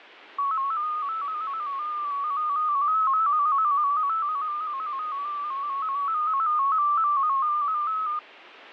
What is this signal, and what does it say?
Multi-tone FSK (Olivia or MFSK type), about 250 Hz wide, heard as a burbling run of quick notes, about 15.625 baud.